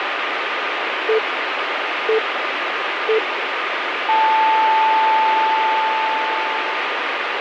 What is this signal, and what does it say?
Radio time signal (three low pips and a long one an octave up, as on NHK), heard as pips, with radio static.